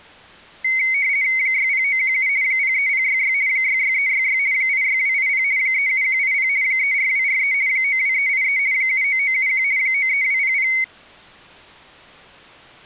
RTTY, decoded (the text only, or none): 60917 03066 66366 86280 37180 34243 92383 79971 93200